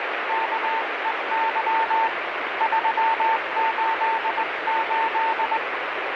Morse code, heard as a keyed tone, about 20 wpm, 900 Hz, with heavy radio static. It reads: KEY 388